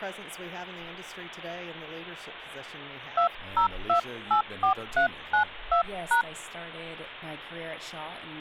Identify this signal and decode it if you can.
DTMF, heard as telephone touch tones, dialled by hand, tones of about 100 ms. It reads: 20284392#